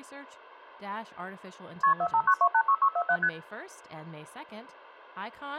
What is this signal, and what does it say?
Multi-frequency trunk signalling (R1, as on North American trunks), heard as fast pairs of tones, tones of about 70 ms, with speech in English. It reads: KP 459286647 ST